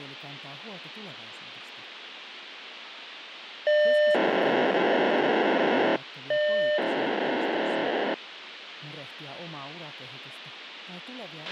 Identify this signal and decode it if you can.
POCSAG pager data (1200 baud), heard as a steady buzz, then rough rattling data, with radio hiss and a squelch burst at the end.